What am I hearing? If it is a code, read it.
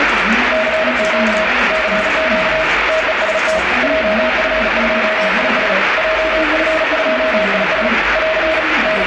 Morse code, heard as a keyed tone, hand-sent with a paddle, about 37 wpm, 640 Hz, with heavy radio static and the noise of a crowd indoors. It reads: CQ CQ TEST JF2IS JF2IS <AR> …